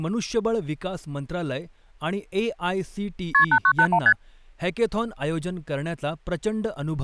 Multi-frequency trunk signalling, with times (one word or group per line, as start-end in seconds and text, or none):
3.3-3.4 KP
3.5-4.0 8981
4.1-4.1 ST